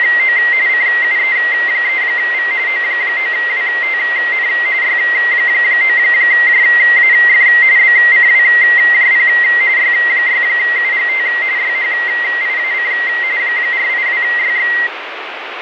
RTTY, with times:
0.0-0.4 …
0.7-2.5 CUE3V
2.7-4.5 O9WTN
4.8-7.5 Y9JAF
7.8-9.3 BCWJP
9.8-11.3 Y6UGT
11.6-12.9 YHIAC
13.4-14.7 482YX

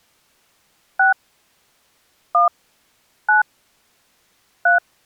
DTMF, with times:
1.0-1.1 6
2.3-2.5 1
3.3-3.4 9
4.7-4.8 3

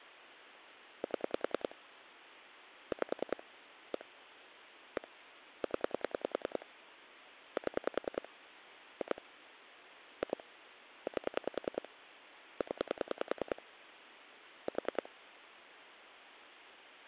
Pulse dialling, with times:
1.0-1.7 7
2.9-3.4 5
3.9-4.0 1
5.0-5.1 1
5.6-6.7 0
7.6-8.3 7
9.0-9.2 2
10.2-10.4 2
11.1-11.9 8
12.6-13.6 0
14.7-15.1 4

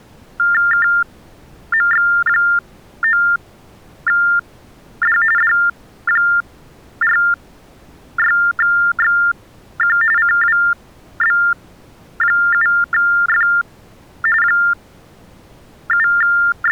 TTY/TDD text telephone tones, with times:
0.7-5.2 KMX9D
5.4-10.0 D46XQ
10.2-13.5 CWB7F
14.4-16.7 …

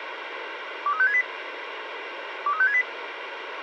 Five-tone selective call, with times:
0.9-1.2 23568
2.5-2.8 23568

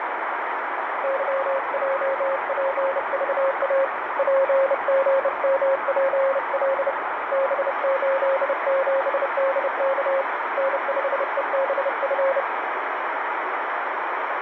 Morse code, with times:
1.0-3.8 YJPVA
4.2-6.9 PGMPL
7.3-10.2 B87DK
10.6-12.4 N5EBF

